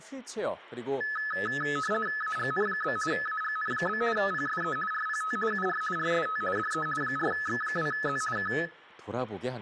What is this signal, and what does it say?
RTTY (50 baud, 450 Hz shift), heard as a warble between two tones, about 1500 Hz centre, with speech in Korean. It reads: AGN? AGN? PSE RPT UR RST DE 4X2Z K